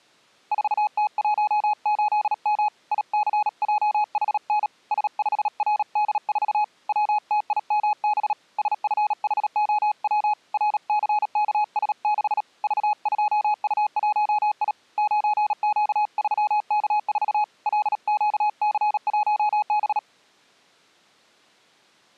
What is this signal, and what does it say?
Morse code, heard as a keyed tone, hand-sent with a paddle, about 37 wpm, 840 Hz. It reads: 4T18M ICJHN S5RD4 WTIMB SFHOW RCKS6 V2U1I 9Q3K4 LQC1B